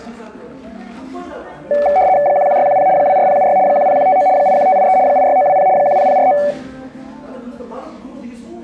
RTTY (75 baud, 170 Hz shift), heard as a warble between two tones, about 670 Hz centre, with room echo and the noise of a cafe. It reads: 11610 24076 10159 81583 86920 10049